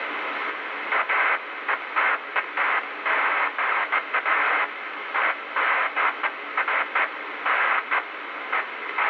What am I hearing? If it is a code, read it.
Bursts of noise, with radio static. There is no code.